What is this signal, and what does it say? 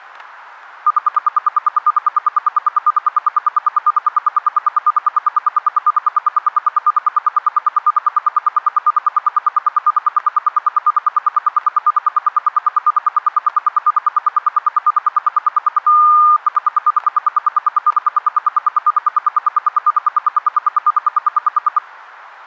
Radio time signal (RWM, Moscow), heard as ten pulses a second, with static crashes.